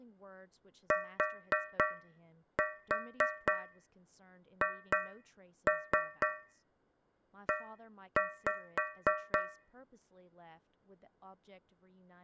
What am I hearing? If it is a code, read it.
Tap code, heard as taps on a metal pipe, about 4 knocks a second, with speech in English. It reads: THE